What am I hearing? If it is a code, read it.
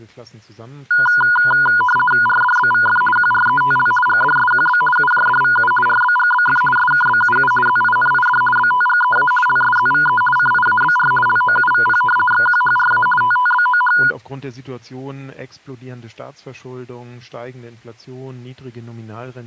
RTTY (50 baud, 450 Hz shift), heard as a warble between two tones, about 1220 Hz centre, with speech in German. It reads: RDBVF QRETL GDSQB UJDVU RBGBF SKBUU ZINID BTGEA LSZVE CIABR LOUVP XQHRA TTBOH